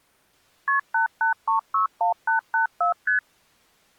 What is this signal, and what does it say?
Multi-frequency trunk signalling (R1, as on North American trunks), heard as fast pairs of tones, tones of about 120 ms. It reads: KP 88361884 ST